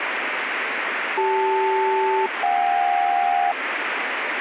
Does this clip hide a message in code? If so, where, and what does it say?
Yes: aircraft SELCAL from 1.2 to 3.5 s, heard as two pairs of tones, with radio static. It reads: CL-JK